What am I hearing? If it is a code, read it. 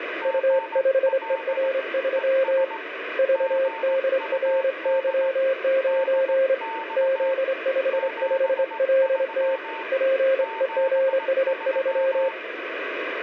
Morse code, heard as two keyed tones, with heavy radio static. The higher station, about 18 wpm, 900 Hz: GL ES GUD DX 73 73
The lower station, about 26 wpm, 530 Hz: U5ER3 VDRY9 Z55LT PEGS3